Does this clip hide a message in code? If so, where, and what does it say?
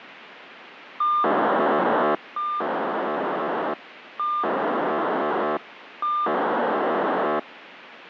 Yes: POCSAG pager data (2400 baud) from 1.0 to 7.4 s, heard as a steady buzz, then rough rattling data, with radio hiss and a squelch burst at the end.